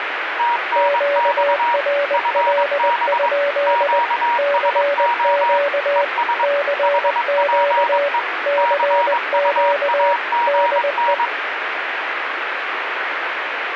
Morse code, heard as two keyed tones, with radio static. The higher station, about 22 wpm, 950 Hz: TNX FB QSO ES HPE CUAGN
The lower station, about 20 wpm, 570 Hz: QRL? CQ CQ CQ DE